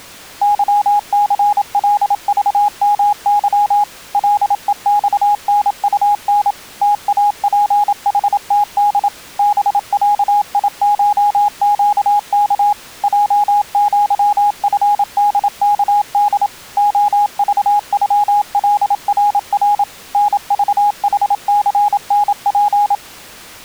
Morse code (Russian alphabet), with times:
0.4-3.8 ЫЦЛЖМЫ
4.1-6.5 ЛЕЬНУН
6.8-9.1 ТАПХТД
9.4-12.7 БЯИШЩК
13.0-16.5 ЙЪФДКД
16.8-19.8 ОЖЮЛРР
20.1-22.9 НЖХЦНП

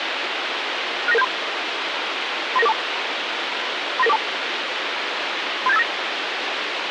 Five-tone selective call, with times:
1.1-1.2 69973
2.6-2.7 39942
4.0-4.2 39942
5.7-5.8 37859

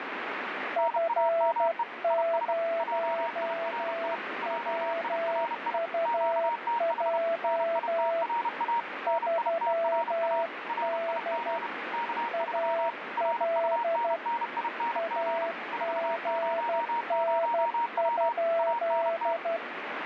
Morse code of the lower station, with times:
0.8-8.2 F0WUJ
9.1-11.6 3D
12.3-14.2 AL
15.0-19.6 AGN?

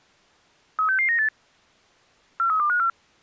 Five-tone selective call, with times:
0.8-1.3 36698
2.4-2.9 43254

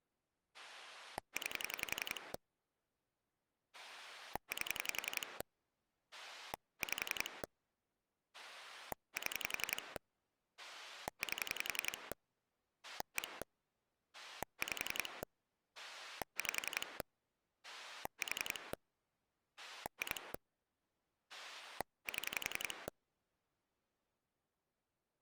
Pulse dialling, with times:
0.5-2.3 9
3.7-5.4 8
6.1-7.4 5
8.3-10.0 7
10.6-12.1 8
12.8-13.4 1
14.1-15.2 5
15.8-17.0 5
17.6-18.7 4
19.6-20.3 2
21.3-22.9 7

